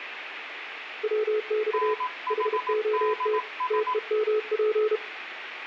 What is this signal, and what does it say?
Morse code, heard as two keyed tones, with radio static and room echo. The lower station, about 32 wpm, 430 Hz: WX HOT TEMP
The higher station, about 18 wpm, 1010 Hz: NHDS